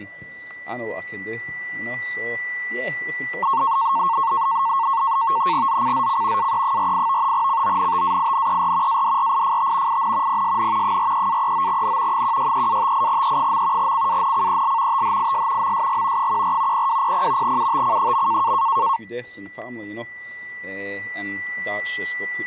NAVTEX (SITOR-B), 100 baud, 170 Hz shift, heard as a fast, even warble, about 1000 Hz centre, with static crashes and a steady whistle near 1970 Hz. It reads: ZCZC AE48 CONTAINER ADRIFT IN PSN 43-39N 163-58E. CANCEL THIS MSG 14 0200 UTC.